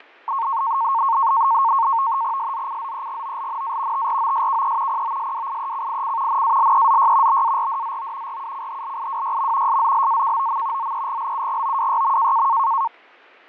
NAVTEX (SITOR-B), 100 baud, 170 Hz shift, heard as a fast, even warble, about 1000 Hz centre, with fading and static crashes. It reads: SZCZEGOLNA TROSKE POSWIECIC NALEZY BARDZO RUCHLIWYM SZLAKOM ZEGLUGOWYM